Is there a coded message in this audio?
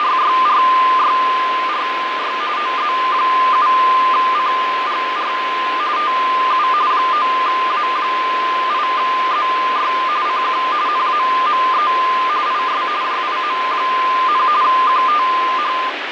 Yes: RTTY (45.45 baud, 170 Hz shift) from 0.0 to 15.9 s, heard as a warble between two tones, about 1120 Hz centre, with radio static and fading. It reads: … OZ7CGR TU 9A8ZY CQ NAME IS JIM, QTH